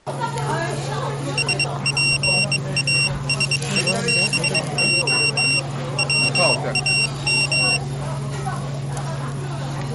Morse code (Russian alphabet), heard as a high beeper, hand-sent with a bug key, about 22 wpm, 2750 Hz, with the noise of a restaurant. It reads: СПАСИБО ВАМ